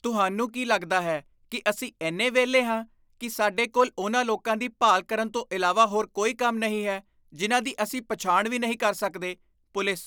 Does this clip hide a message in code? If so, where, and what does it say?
No, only speech in Punjabi.